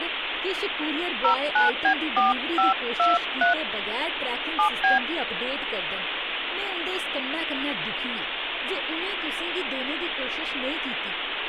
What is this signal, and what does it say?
DTMF, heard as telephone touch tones, dialled by hand, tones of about 130 ms, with phone line noise and speech in Dogri. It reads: 09B4523 7B